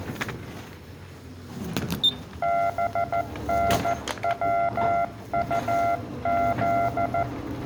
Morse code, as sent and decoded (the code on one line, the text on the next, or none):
-... -. .-- ..- --..
BNWUZ